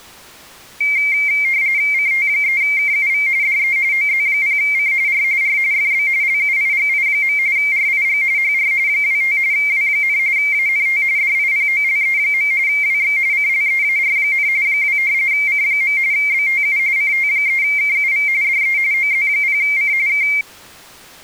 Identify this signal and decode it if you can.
RTTY (45.45 baud, 170 Hz shift), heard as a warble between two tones, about 2200 Hz centre. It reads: CT3KUV DE OZ0C R R FB LUIGI. RIG HR 25 W, ANT DIPOLE. WX CLEAR, 2 C. BTU CT3KUV DE OZ0C K